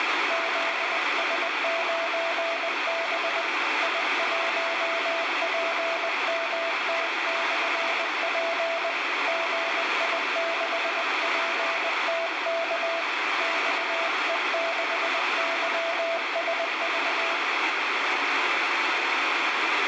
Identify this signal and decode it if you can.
Morse code, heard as a keyed tone, hand-sent with a paddle, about 20 wpm, 670 Hz, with heavy radio static. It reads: ZS9B I1PMT/P GI6PTK XE6YSV